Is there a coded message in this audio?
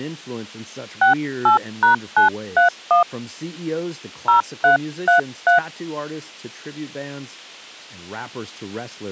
Yes: DTMF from 1.0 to 5.6 s, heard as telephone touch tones, dialled by hand, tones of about 120 ms, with speech in English. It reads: 68#931 0333